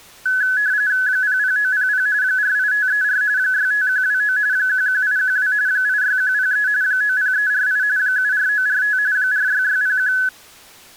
RTTY (45.45 baud, 170 Hz shift), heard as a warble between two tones, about 1600 Hz centre. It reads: 00900 48534 65129 11812 86103 90348 74945 46601